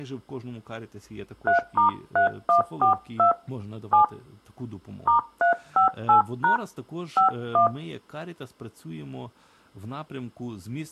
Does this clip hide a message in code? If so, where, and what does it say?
Yes: DTMF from 1.5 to 7.7 s, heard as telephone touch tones, dialled by hand, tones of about 120 ms, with speech in Ukrainian. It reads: 3*3142 7 *358# 51